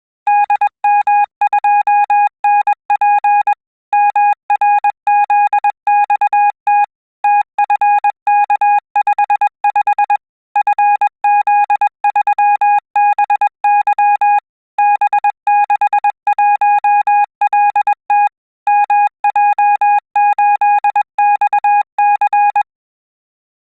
Morse code, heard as a keyed tone, machine-sent, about 21 wpm, 820 Hz. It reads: DM2NP MRZXT TFK55 FZ3BY B61LT MJ8XC